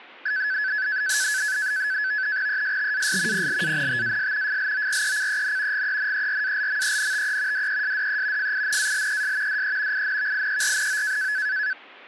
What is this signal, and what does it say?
NAVTEX (SITOR-B), 100 baud, 170 Hz shift, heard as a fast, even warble, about 1600 Hz centre. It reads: ESTAS PLANTAS FLORECEN GENERALMENTE DESDE FINALES DE INVIERNO